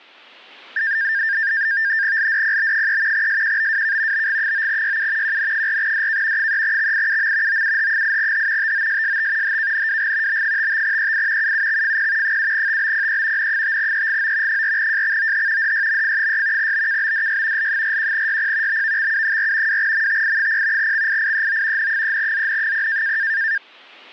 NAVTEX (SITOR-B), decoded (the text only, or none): LDPB3 SQBWK BG9YU QN4DK 3XIUM OUH8H TOSST HKNWG B55EI UUXFP 7TBPE N5EGO 4JXOH DYMF6 BKBDY L41YP BVXU4 2MTI0 XIIEO N3ZN0